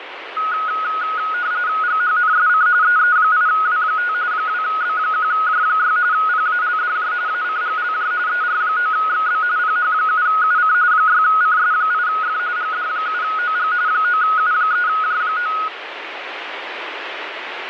RTTY (45.45 baud, 170 Hz shift), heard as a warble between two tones, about 1360 Hz centre, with radio static. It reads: GHNSC EE8W5 2B1J6 PALDJ ACGLJ ER9XB PH7UC 6CS8F GD7OG 9U3J9